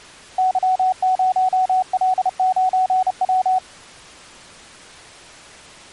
Morse code, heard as a keyed tone, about 31 wpm, 750 Hz. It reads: Y0L9W